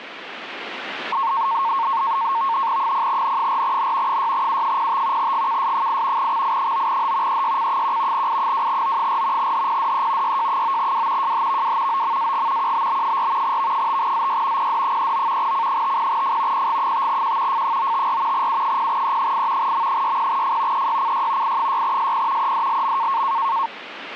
NAVTEX (SITOR-B), 100 baud, 170 Hz shift, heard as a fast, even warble, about 1000 Hz centre, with radio static. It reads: 0N4N 6U05 GKS8 XI9H EYC1 I2O4 HPDE YJ9W JHVW OMAG QBB4 V5ZY PD39 C50F PG5Q F954 U0E8 M60F EYCY I6SP EDLM